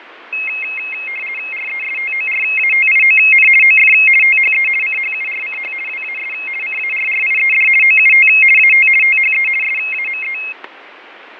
RTTY (50 baud, 450 Hz shift), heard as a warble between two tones, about 2350 Hz centre, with radio static, fading and static crashes. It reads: RESTORATION OF THE CHURCH WAS CARRIED OUT AT THE SAME